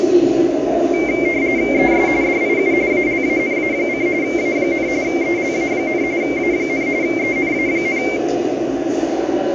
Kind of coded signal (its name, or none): RTTY